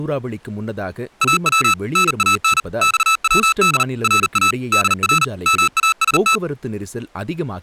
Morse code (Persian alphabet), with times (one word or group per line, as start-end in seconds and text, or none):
1.2-1.7 او
2.0-2.6 نان
2.8-3.8 خود
4.0-4.5 را
4.7-5.2 در
5.5-6.4 ماست